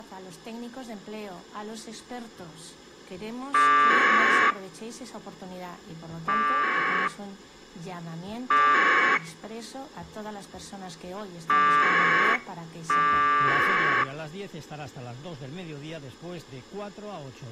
Packet radio (AX.25, as in APRS), 1200 baud, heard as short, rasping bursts.